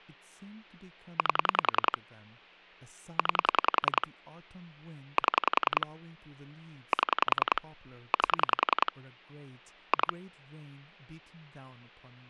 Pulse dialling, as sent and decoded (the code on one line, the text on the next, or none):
8 / 9 / 7 / 7 / 8 / 2
8 9 7 7 8 2